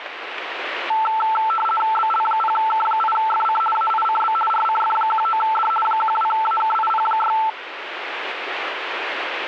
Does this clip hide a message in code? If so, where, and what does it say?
Yes: RTTY (50 baud, 450 Hz shift) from 0.9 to 7.5 s, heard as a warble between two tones, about 1110 Hz centre, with radio static. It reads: BL0K8FC AICB RCF19D 12AKIP6